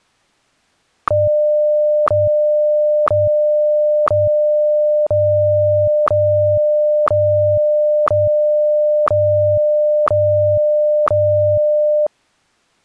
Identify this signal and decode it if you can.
Radio time signal (WWVH, Hawaii), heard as ticks, one a second.